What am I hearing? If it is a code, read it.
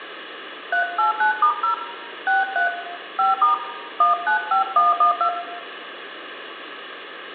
DTMF, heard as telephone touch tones, dialled by hand, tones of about 140 ms, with room echo. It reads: 389*0 63 5* 195112